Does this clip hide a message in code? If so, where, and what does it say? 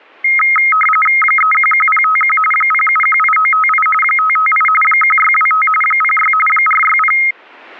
Yes: RTTY (45.45 baud, 850 Hz shift) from 0.2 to 7.3 s, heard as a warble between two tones, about 1700 Hz centre. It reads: 311051 0718958 558 1625 06 460